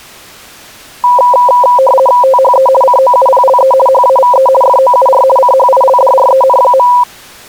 RTTY (50 baud, 450 Hz shift), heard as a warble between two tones, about 760 Hz centre. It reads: THE COUPLE HAVE FOUR CHILDREN.